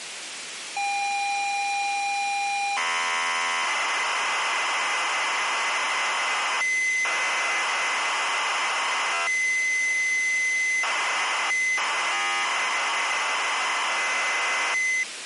ZX Spectrum tape loading, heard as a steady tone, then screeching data, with tape hiss.